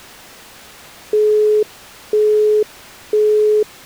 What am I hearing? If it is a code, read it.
Telephone call progress tone (single-tone plan, as in Europe, Japan and elsewhere), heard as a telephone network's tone, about 420 Hz, 0.5 s on and 0.5 s off. Busy tone.